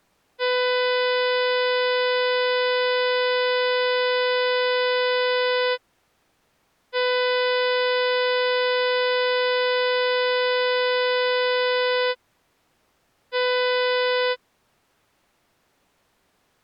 Ship horn signal, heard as a ship's horn, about 500 Hz. 2 long, 1 short. At sea: I intend to overtake on your starboard side.